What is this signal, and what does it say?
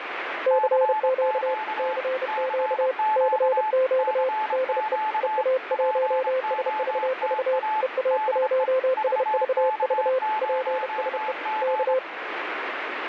Morse code, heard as two keyed tones, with radio static. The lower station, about 31 wpm, 520 Hz: CQ CQ CQ DE EA1SVV EA1SVV PSE K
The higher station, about 25 wpm, 860 Hz: CQ CQ CQ POTA DE VK0G